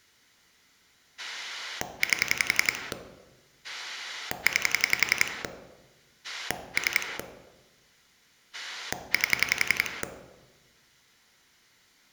Pulse dialling, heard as a rotary dial, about 11 pulses a second, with room echo. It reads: 8 9 3 8